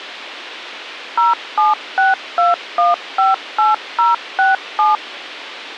DTMF, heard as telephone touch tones, dialled by machine, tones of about 160 ms. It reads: 0762158067